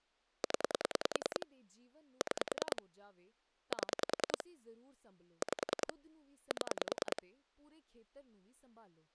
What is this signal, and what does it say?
Pulse dialling, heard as clicks on a phone line, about 10 pulses a second, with speech in Punjabi. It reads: 0 6 7 5 7